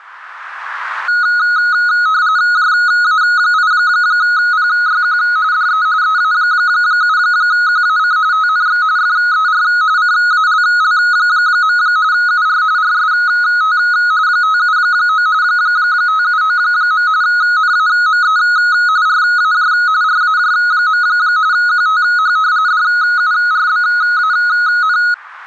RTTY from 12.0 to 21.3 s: UR RST 579 579. NAME RAJ RAJ.

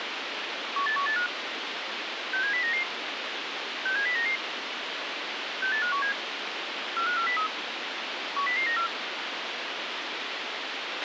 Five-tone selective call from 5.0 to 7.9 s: 68517 45403

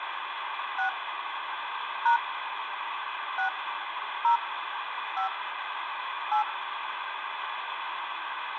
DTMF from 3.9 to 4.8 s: 0

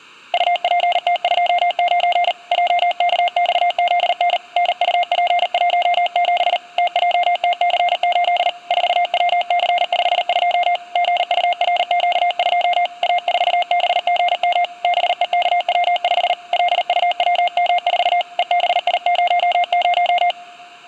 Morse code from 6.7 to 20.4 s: TJTC8 4WC52 GURQ2 A4BGM BEKW5 LUWM4 EBI00

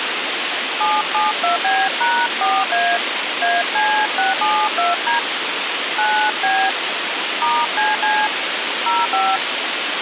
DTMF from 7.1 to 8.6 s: *CC

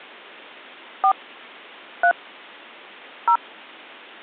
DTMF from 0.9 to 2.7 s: 4 3

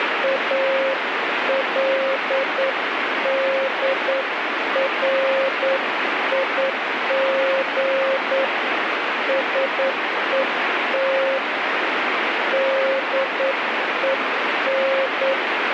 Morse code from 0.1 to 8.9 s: ALDRIG

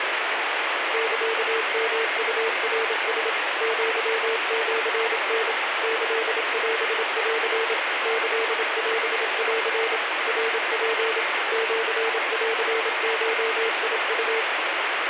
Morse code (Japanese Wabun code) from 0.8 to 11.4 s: サヨウナラ アシタ キオン キオン ナツ

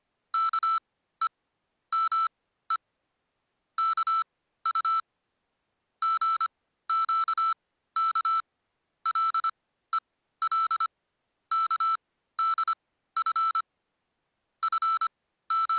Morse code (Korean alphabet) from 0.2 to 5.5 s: 아마 이

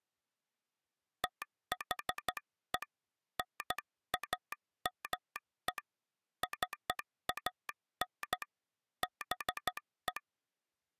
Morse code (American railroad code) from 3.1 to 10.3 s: NAME CAN BE

